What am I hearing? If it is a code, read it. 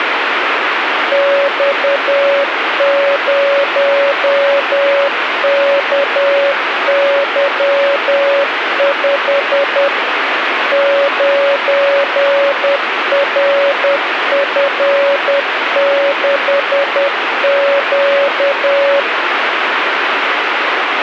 Morse code, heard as a keyed tone, machine-sent, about 10 wpm, 560 Hz, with radio static. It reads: X0KY5 9RF6Q